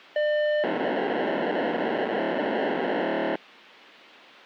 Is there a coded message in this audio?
Yes: POCSAG pager data (1200 baud) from 0.2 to 3.4 s, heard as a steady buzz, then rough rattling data.